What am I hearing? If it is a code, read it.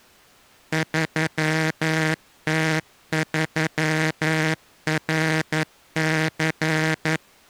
Morse code, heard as a buzzer, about 11 wpm. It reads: 3T3RC